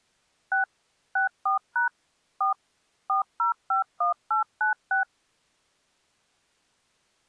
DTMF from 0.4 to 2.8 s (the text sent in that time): 6 64# 4